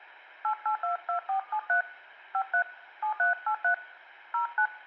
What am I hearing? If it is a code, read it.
DTMF, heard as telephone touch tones, dialled by hand, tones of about 100 ms, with room echo. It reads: 8822473 53 7383 09